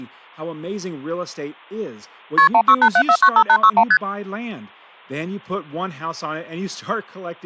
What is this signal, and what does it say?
Multi-frequency trunk signalling (R1, as on North American trunks), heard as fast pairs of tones, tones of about 70 ms, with speech in English. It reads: KP 1687495861 ST